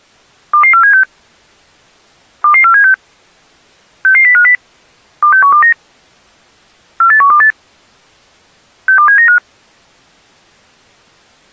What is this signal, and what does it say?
Five-tone selective call (CCIR), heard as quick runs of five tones, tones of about 100 ms. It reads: 22476 22476 66050 26129 48128 62795